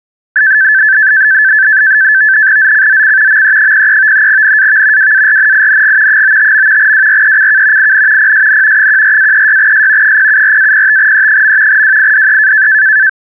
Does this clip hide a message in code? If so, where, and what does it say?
Yes: NAVTEX (SITOR-B), 100 baud, 170 Hz shift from 0.4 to 13.1 s, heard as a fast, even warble, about 1650 Hz centre. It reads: ZCZC ME03 NAV WARNING 95. WRECK IN PSN 14-36S 074-05E. WIDE